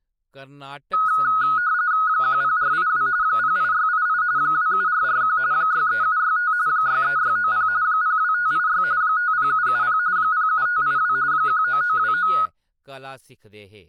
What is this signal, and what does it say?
RTTY (45.45 baud, 170 Hz shift), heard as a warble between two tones, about 1360 Hz centre, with speech in Dogri. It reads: 10482 08688 27441 63765 63690 02586 50770 07582 19929